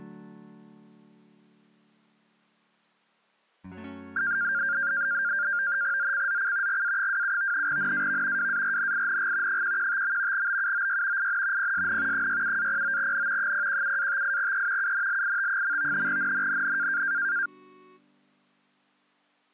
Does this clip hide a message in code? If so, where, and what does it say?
Yes: NAVTEX (SITOR-B), 100 baud, 170 Hz shift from 4.2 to 17.5 s, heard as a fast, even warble, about 1500 Hz centre. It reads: ZCZC GA27 NAV WARNING 115. BUOY IN PSN 67-09N 017-58E UNLIT. NNNN